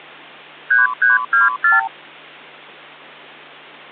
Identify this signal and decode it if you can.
Multi-frequency trunk signalling (R2, with the far end's replies), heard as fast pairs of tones, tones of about 160 ms, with hum. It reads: 3324